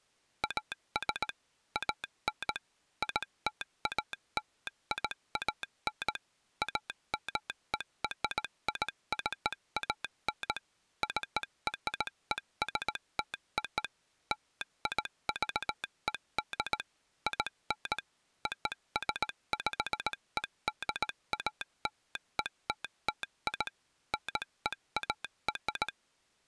Morse code (American railroad code), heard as a telegraph sounder, machine-sent. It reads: AS AN ITALIAN AMERICAN CRESTO LIVED IN OSPEDALETTI NEAR